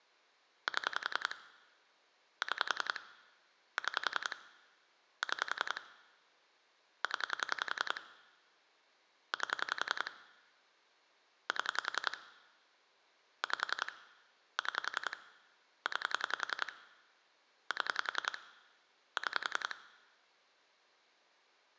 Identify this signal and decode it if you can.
Pulse dialling, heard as clicks on a phone line, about 10 pulses a second. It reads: 7 6 6 6 0 8 7 5 6 9 7 6